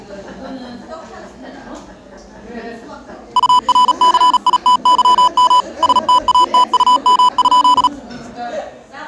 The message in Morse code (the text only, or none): URCITYM STATUM?